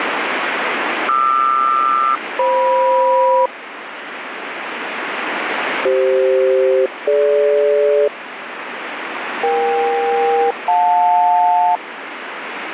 Aircraft SELCAL, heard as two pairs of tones, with radio static. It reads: QR-FM CF-DG EK-JL